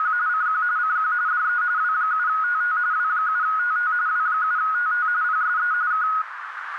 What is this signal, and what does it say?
RTTY (45.45 baud, 170 Hz shift), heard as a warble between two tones, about 1360 Hz centre, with radio static and a narrow filter. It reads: … CQ CQ DE W7TT W7TT W7TT PSE K